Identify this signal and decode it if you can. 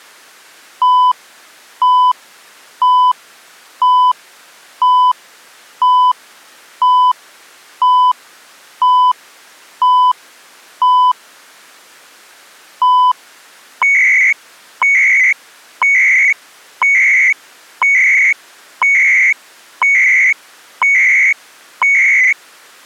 Radio time signal (CHU, Canada), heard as beeps and data bursts, one a second.